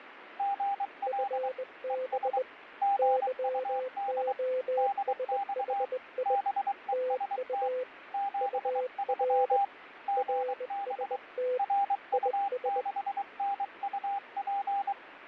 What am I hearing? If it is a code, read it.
Morse code, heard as two keyed tones, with radio static and fading. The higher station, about 23 wpm, 800 Hz: GL ES GUD DX BEST 73 GB RU6NUP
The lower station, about 20 wpm, 510 Hz: FB YOSHI TU UR RST IS